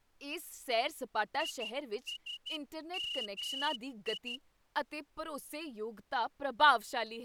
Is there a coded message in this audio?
Yes: Morse code (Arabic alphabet) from 1.3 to 4.4 s, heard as a whistle, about 12 wpm, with speech in Punjabi. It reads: يسمي